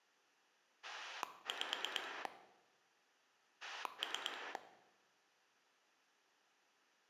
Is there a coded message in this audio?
Yes: pulse dialling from 0.8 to 4.6 s, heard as a rotary dial, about 9 pulses a second, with room echo. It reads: 5 3